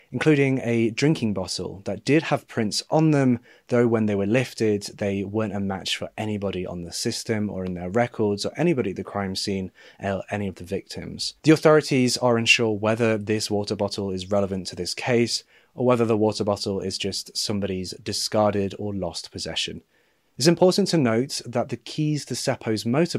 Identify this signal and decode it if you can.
Speech in English. There is no code.